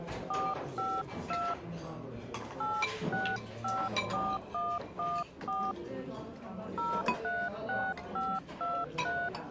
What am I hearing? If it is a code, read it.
DTMF, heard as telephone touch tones, dialled by hand, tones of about 240 ms, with the noise of a crowd indoors. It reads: 452 8654114 036523